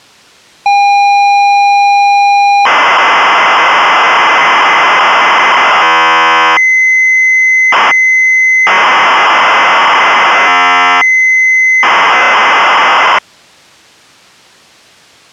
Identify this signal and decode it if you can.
ZX Spectrum tape loading, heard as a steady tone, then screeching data.